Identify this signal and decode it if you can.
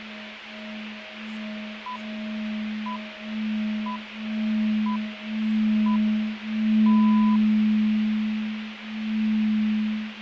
Radio time signal (six pips, as the Greenwich Time Signal), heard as pips, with radio hiss.